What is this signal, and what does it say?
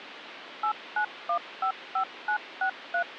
DTMF, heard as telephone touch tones, dialled by machine, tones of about 90 ms, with phone line noise. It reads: 89155963